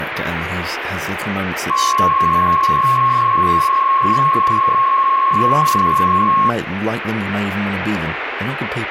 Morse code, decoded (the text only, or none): none